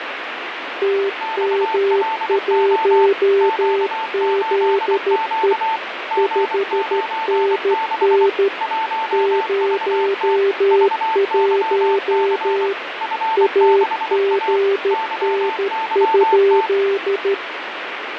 Morse code, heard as two keyed tones, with radio static and fading. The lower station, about 13 wpm, 400 Hz: TM1ZE 5NN 01 AGN?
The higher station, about 24 wpm, 890 Hz: XLO Q8Q G96 1VT VYC F6A YYT